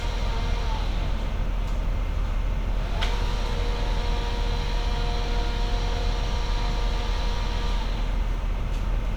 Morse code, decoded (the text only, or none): none